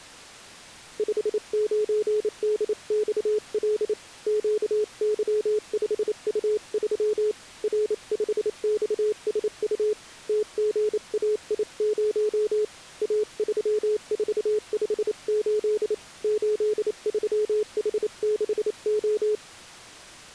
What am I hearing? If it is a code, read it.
Morse code, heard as a keyed tone, hand-sent with a paddle, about 28 wpm, 420 Hz. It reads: 59DXL QY5U3 R5XSU TGAI0 A3458 83H6O